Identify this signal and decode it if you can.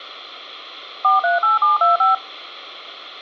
DTMF, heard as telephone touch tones, dialled by machine, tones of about 150 ms, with hum. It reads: 438725